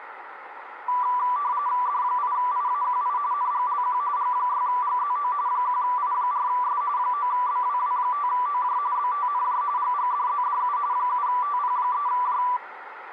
RTTY (45.45 baud, 170 Hz shift), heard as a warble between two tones, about 1080 Hz centre, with radio static and a narrow filter. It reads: D8IAQI NGLQ G6GZO 1I4S 9BWW5OJ BTNJ GGDZDU 7TP3J